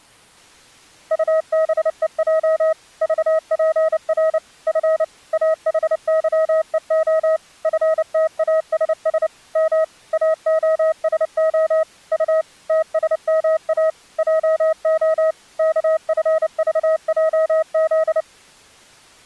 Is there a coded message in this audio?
Yes: Morse code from 1.1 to 18.3 s, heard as a keyed tone, machine-sent, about 29 wpm, 640 Hz. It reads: UBEJ VPR F AHYEO FTASS M AOSO U TSMA JO KFVJZ